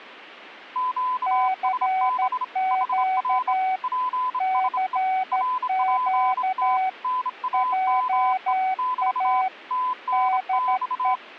Morse code, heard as two keyed tones. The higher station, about 27 wpm, 1010 Hz: QSB HR PSE RPT NAME <BT> TNX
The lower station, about 13 wpm, 750 Hz: CQ CQ JA DE